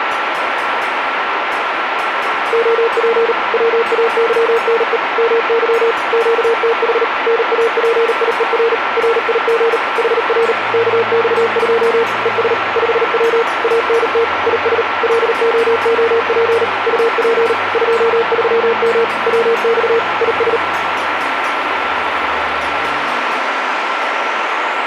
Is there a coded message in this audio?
Yes: Morse code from 2.5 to 20.6 s, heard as a keyed tone, machine-sent, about 38 wpm, 460 Hz, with radio static and a steady whistle near 1350 Hz. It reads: OP WAYNE MY QTH NAPIER RIG HR KX2 ES 5W ANT IS LOOP UP 23M WX IS